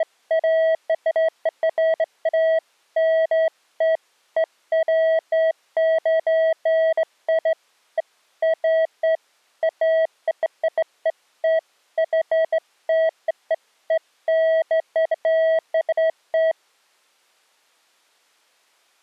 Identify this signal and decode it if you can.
Beeps of irregular length. There is no code.